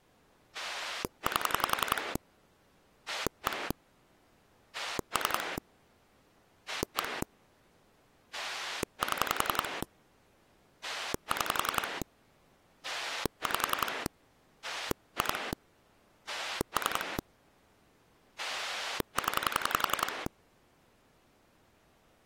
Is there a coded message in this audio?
Yes: pulse dialling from 0.5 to 20.3 s, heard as a rotary dial, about 11 pulses a second. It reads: 8 1 3 1 7 6 5 2 3 0